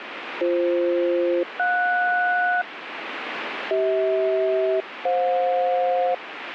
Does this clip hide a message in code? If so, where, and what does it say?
Yes: aircraft SELCAL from 0.4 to 6.1 s, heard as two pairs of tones, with radio static. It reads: BF-JS CH-FJ